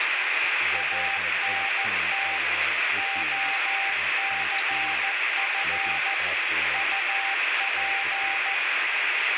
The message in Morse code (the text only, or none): ANT OCF UP